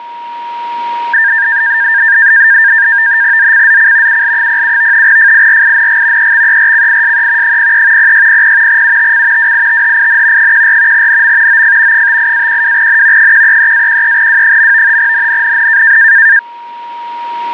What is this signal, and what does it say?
NAVTEX (SITOR-B), 100 baud, 170 Hz shift, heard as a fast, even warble, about 1700 Hz centre, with a steady whistle near 950 Hz. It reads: ZCZC UL07 FIRING EXERCISE 03 0600 UTC WITHIN 14 NM OF 58-12N 133-13W. NNNN